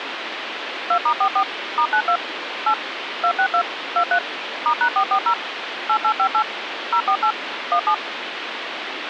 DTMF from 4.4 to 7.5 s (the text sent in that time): *#440 8858 048